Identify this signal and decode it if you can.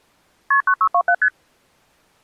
Multi-frequency trunk signalling (R1, as on North American trunks), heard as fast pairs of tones, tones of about 70 ms. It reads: KP 9627 ST